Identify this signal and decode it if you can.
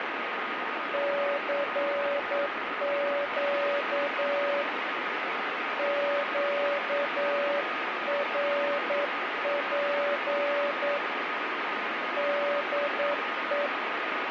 Morse code, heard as a keyed tone, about 9 wpm, 570 Hz, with radio static and a steady whistle near 1240 Hz. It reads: CQ QRP DE